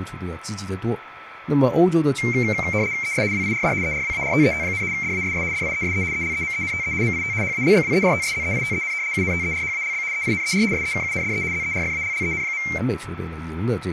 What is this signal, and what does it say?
RTTY (75 baud, 170 Hz shift), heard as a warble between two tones, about 2200 Hz centre, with radio static, a steady whistle near 1320 Hz and speech in Chinese. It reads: ES WIRD ERWARTET, DASS DIESE ELEMENTE MIT HALBWERTSZEITEN UNTERHALB EINER SEKUNDE ZERFALLEN.